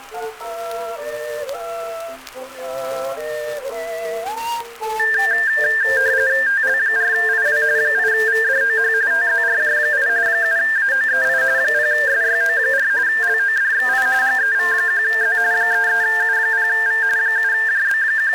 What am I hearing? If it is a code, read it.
RTTY (45.45 baud, 170 Hz shift), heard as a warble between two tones, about 1700 Hz centre. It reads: TL4IW 8VDOH TZRJ8 7AOEI 0SYO4 LODXI GEV1Z 33U0V …